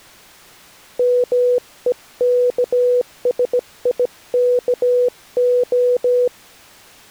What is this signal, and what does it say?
Morse code, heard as a keyed tone, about 17 wpm, 490 Hz. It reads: MEKSIKO